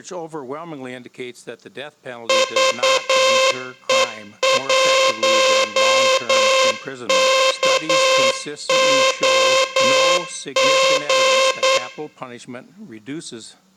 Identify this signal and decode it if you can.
Morse code, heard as a buzzer, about 9 wpm, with room echo. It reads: VE1KOG